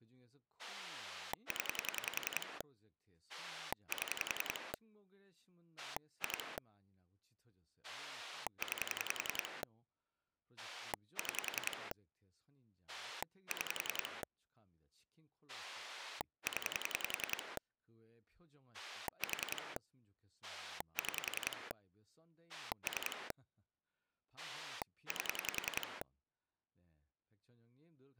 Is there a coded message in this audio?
Yes: pulse dialling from 0.6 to 26.0 s, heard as a rotary dial, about 10 pulses a second, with speech in Korean. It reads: 0 7 2 9 6 6 0 4 6 3 8